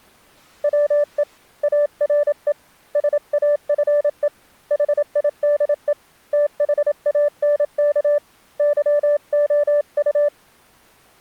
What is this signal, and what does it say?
Morse code, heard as a keyed tone, hand-sent with a paddle, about 27 wpm, 590 Hz. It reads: WE ARE SAFE HIDE THANK YOU